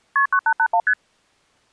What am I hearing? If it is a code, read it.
Multi-frequency trunk signalling (R1, as on North American trunks), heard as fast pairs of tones, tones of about 70 ms. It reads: KP 9881 ST